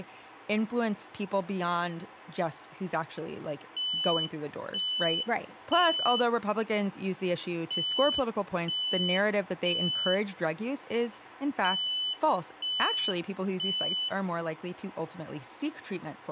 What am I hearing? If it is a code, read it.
Alarm pattern, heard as an alarm's beeps, played three times, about 3000 Hz, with speech in English. Temporal three. Smoke or fire, evacuate.